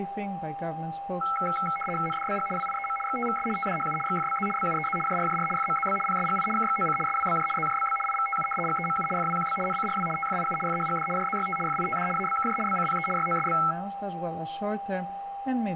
RTTY (75 baud, 850 Hz shift), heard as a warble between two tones, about 1750 Hz centre, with a steady whistle near 800 Hz. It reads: NDBG WIEM XTVS TDHU XFBZ BUEZ JRJR FMZB PSGI KXOC SWBJ ZJBB IVTU GEMU FWQB NCRW TFIU FHGD JZYT FITD ABKJ BCPE YOSB